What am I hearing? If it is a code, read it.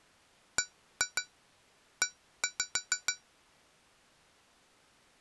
Tap code, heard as taps on glass, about 6 knocks a second. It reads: BE